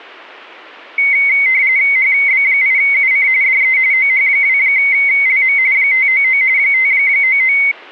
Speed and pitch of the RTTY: 45.45 baud, 170 Hz shift, 2150 Hz centre

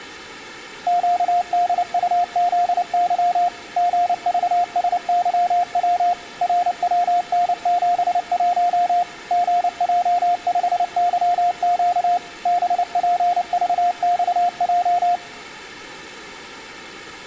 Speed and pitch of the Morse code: 29 wpm, 700 Hz

